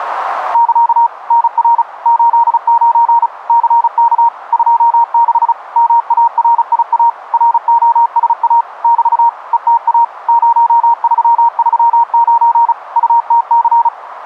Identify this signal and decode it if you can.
Morse code, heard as a keyed tone, machine-sent, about 35 wpm, 930 Hz, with radio static. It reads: <KA> NR 89 CK 26 MARIA ROSA <BT> ETA 0339 UTC